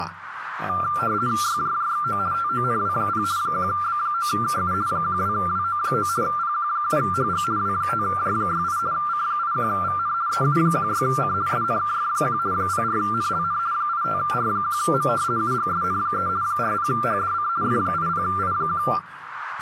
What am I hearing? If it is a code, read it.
RTTY (50 baud, 170 Hz shift), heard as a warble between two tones, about 1280 Hz centre, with radio static and speech in Chinese. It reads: YJJXO TONW0 1B9KU 12WO9 PQ7HG W5J68 C81VN EU16C SNKF1 04NLN 85R1M UGSN3 40HDC F80I1